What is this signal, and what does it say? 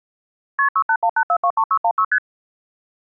Multi-frequency trunk signalling (R1, as on North American trunks), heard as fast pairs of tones, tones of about 70 ms. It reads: KP 6818423616 ST